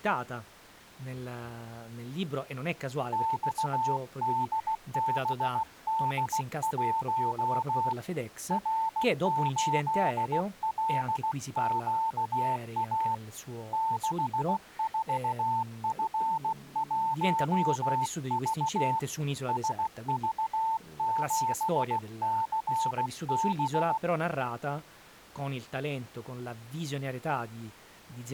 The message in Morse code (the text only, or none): XDBD1 R8LQA 64F1V SV7CB